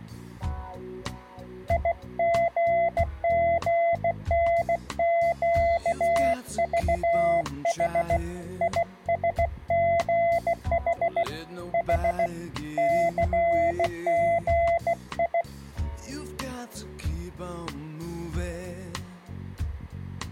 Morse code, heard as a keyed tone, hand-sent with a bug key, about 16 wpm, 680 Hz. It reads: IGGNQVH ISGH H CGI